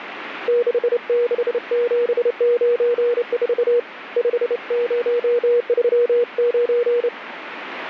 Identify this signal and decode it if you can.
Morse code, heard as a keyed tone, hand-sent with a straight key, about 28 wpm, 480 Hz, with radio static. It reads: 66794 5039